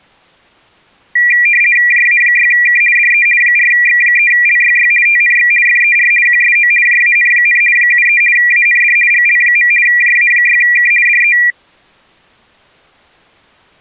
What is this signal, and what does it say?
RTTY (50 baud, 450 Hz shift), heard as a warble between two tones, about 2150 Hz centre. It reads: JA6K DE 4X3LYY TNX FER QSO JAN, 73 AND GL. JA6K DE